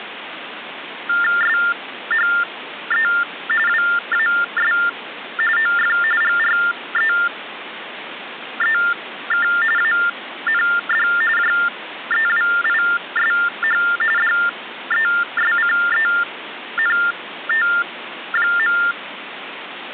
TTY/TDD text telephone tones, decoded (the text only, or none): SHE WAS OF GREEK AND JEWISH DESCENT.